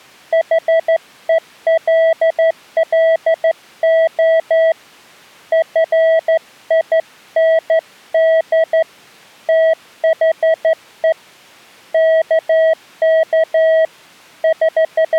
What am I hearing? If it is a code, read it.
Morse code, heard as a keyed tone, hand-sent with a straight key, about 13 wpm, 650 Hz. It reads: HELLO FIND THE KK …